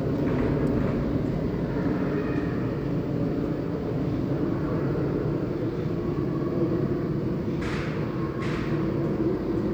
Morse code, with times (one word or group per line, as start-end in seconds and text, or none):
none